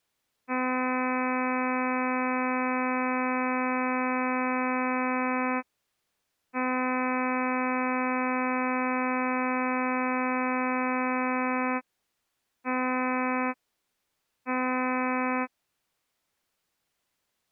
Ship horn signal, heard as a ship's horn, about 260 Hz. 2 long, 2 short. At sea: I intend to overtake on your port side.